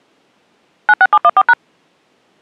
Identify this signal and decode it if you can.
DTMF, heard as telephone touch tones, dialled by machine, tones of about 50 ms. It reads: 96714#